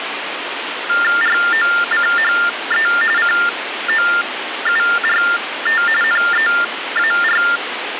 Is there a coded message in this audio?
Yes: TTY/TDD text telephone tones (45.45 baud Baudot) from 0.9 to 7.6 s, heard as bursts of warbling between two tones, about 400 Hz shift, 1600 Hz centre, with phone line noise. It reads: ROCHE COURT NEAR